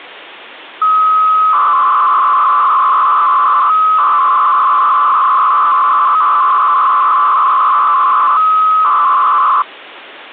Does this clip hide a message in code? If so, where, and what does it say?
Yes: 300-baud modem data (Bell 103 tones) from 0.8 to 9.6 s, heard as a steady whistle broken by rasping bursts, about 300 baud, 200 Hz shift.